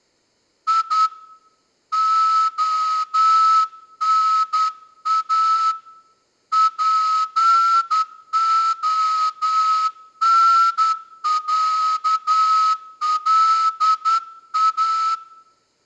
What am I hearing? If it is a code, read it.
Morse code (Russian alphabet), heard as a whistle, hand-sent with a straight key, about 10 wpm, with room echo. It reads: И ОНА ПОНЯЛА